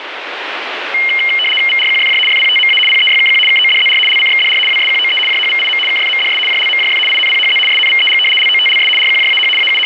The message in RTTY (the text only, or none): VRQFJ FPTMA PEYKQ KODZR LCXDR WSQOE JHVIM KFMDS JLMJF INPHZ SNVEG LOTLS RQJAH …